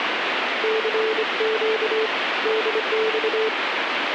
Morse code, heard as a keyed tone, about 25 wpm, 440 Hz, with radio static. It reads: CQ DX